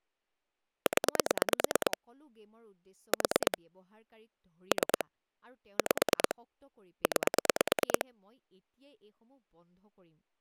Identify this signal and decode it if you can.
Pulse dialling, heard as clicks on a phone line, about 9 pulses a second, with speech in Assamese. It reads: 0 4 3 5 9